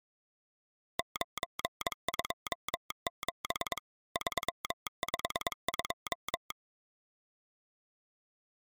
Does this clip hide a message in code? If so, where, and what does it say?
Yes: Morse code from 0.9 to 6.6 s, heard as a telegraph sounder, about 22 wpm. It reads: 927 352